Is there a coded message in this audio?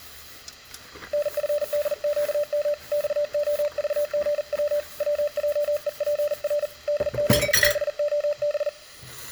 Yes: Morse code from 1.1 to 8.7 s, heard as a keyed tone, hand-sent with a paddle, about 40 wpm, 590 Hz, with kitchen noise. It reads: NFDQM XOVGW WJEPR DZBOB